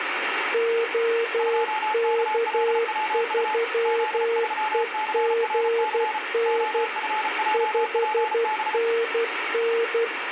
Morse code, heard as two keyed tones, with radio static. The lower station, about 12 wpm, 460 Hz: OK3EGN 5NN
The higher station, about 34 wpm, 860 Hz: 2KLWU Z3CRC OFJPB